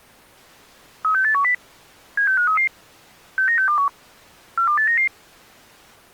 Five-tone selective call (CCIR), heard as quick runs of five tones, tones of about 100 ms. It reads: 36810 76533 69621 42899